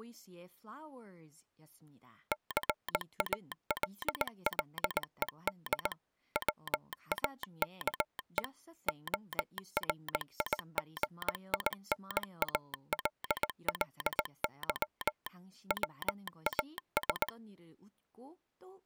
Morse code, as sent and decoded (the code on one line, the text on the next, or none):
-.-. .- .-.. .-.. . -.. / .-- .- -.- . / --- .-. .. --. .. -. .- .-.. .-.. -.-- / .-- .- ...
CALLED WAKE ORIGINALLY WAS